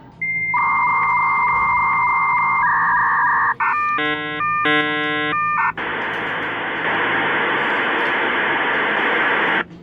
Dial-up modem handshake (V.34 or later), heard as a whistle, warbles, then hiss, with the noise of a cafe.